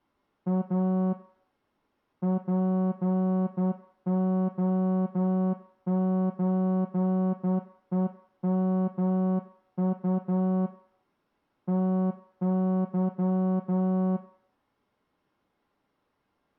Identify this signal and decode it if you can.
Morse code (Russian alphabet), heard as a horn, hand-sent with a straight key, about 10 wpm, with room echo. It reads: А ПОЧЕМУ ТЫ